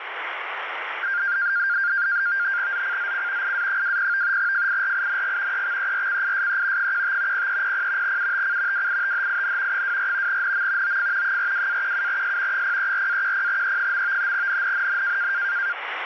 NAVTEX (SITOR-B), 100 baud, 170 Hz shift, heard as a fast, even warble, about 1500 Hz centre, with radio static. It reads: ZCZC IA20 FIRING EXERCISE 15 0300 UTC WITHIN 24 NM OF 42-17S 034-10E. NNNN